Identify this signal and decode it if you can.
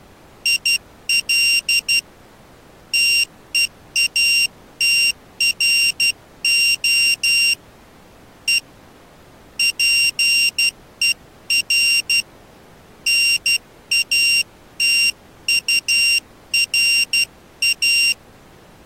Morse code, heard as a high beeper, hand-sent with a paddle, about 12 wpm, 2750 Hz. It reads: IL TEATRO E PER NATURA